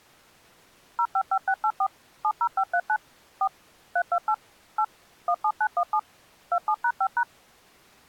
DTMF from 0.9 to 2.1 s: 055684

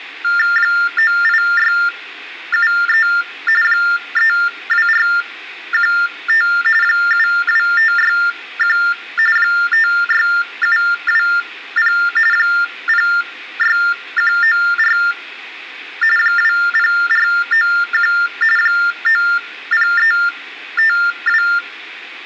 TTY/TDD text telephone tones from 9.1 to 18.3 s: 56720 06194 20491

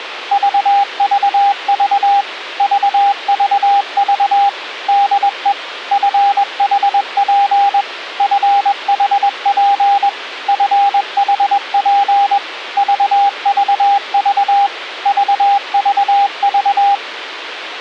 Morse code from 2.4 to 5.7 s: VVV DE

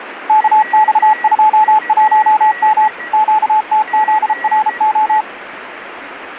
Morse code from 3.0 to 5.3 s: QTZRO

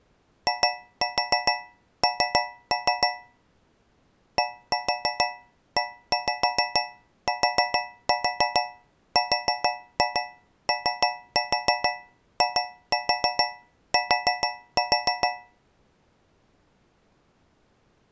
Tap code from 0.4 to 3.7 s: IN

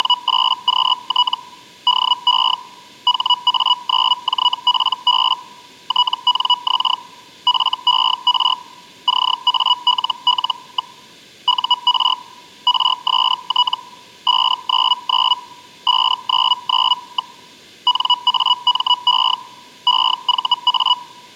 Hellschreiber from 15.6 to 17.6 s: 599.

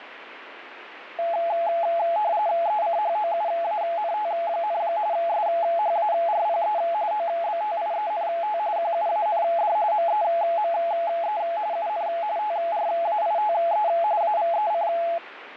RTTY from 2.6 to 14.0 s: ECHOUANT, SHARPE OBTIENT QUAND MEME UN TRAITE

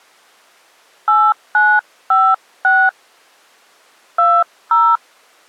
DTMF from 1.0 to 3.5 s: 8956

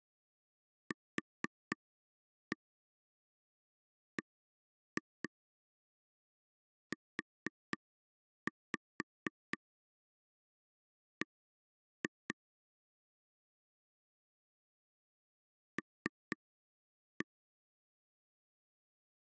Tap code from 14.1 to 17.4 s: L

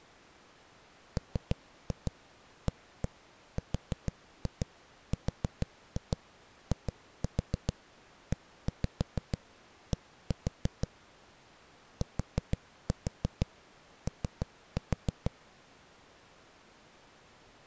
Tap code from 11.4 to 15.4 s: TO

